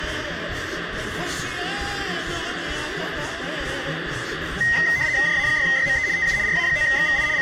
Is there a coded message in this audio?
Yes: RTTY (75 baud, 170 Hz shift) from 4.6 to 7.4 s, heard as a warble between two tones, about 1950 Hz centre, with radio static. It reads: JA6YME TU RA9XVI …